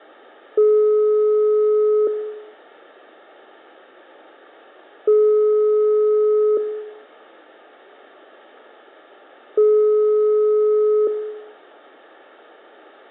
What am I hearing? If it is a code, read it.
Telephone call progress tone (single-tone plan, as in most of Europe), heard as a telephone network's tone, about 420 Hz, 1.5 s on and 3 s off, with room echo. Ringback tone.